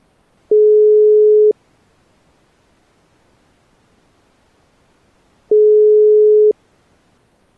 Telephone call progress tone (single-tone plan, as in most of Europe), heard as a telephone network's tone, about 420 Hz, 1 s on and 4 s off. Ringback tone.